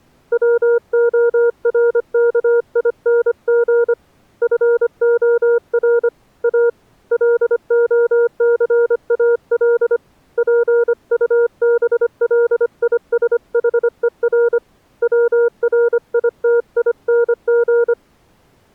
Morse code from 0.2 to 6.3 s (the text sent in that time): WORKING FOR